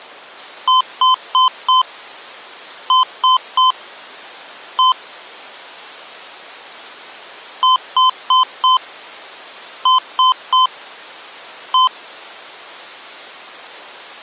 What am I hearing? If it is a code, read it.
Beep code, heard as beeps from a small speaker, played twice, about 1030 Hz. 4-3-1. In Phoenix BIOS tables: memory failure above the first 64 KB.